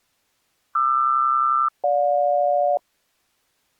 Aircraft SELCAL, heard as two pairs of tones. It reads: QR-GJ